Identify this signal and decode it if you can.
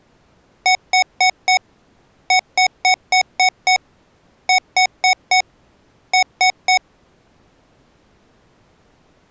Beep code, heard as beeps from a small speaker, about 740 Hz. 4-6-4-3.